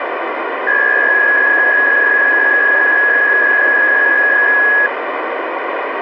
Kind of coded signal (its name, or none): PSK63